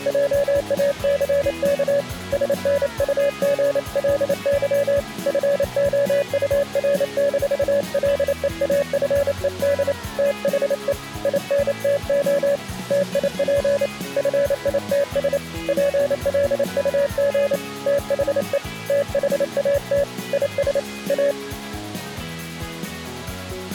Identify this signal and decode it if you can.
Morse code, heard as a keyed tone, hand-sent with a paddle, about 28 wpm, 570 Hz. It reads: JACK SNUGLY FOUR-LEAFED THE INTO TIP FITS PLUG THE THAT IS A